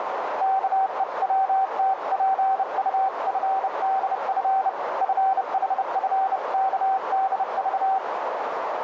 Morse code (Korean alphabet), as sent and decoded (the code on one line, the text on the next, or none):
-.- . .-- - .--. ..- ..-. -.. ..-. / ..-. .... ..-. -.- -.. ...-
아버지는 눈을